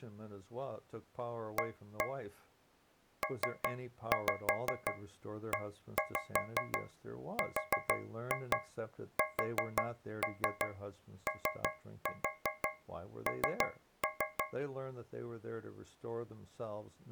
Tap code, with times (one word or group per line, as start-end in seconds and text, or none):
1.6-2.1 A
3.2-14.4 PERSON